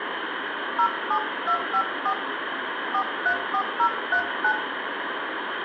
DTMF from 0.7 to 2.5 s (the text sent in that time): 07254